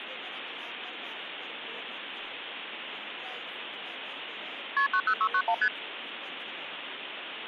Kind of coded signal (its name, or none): multi-frequency trunk signalling